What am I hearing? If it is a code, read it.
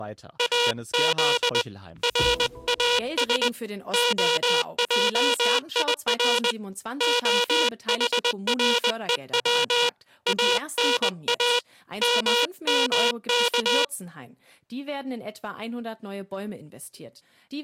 Morse code (Hebrew alphabet), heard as a buzzer, hand-sent with a paddle, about 20 wpm. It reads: אז ראש העיר החרוץ אנא ממך